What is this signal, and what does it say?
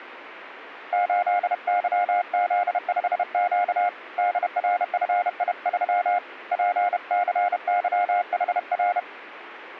Morse code, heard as a keyed tone, hand-sent with a paddle, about 31 wpm, 710 Hz. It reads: 8YZ5Q DRFI3 PCYHR